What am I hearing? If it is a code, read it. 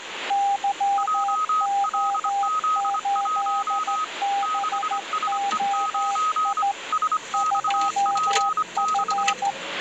Morse code, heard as two keyed tones, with radio static and the noise inside a car. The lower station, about 14 wpm, 800 Hz: YO8BOI 2F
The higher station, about 25 wpm, 1260 Hz: JLZ1 6SE9 SXP6